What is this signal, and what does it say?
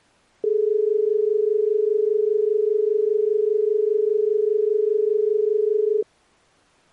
Telephone call progress tone (as in Australia), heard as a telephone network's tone, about 430 Hz. Dial tone.